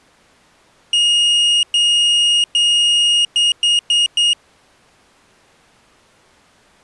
Beep code, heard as a piezo beeper, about 2850 Hz. 3 long, 4 short.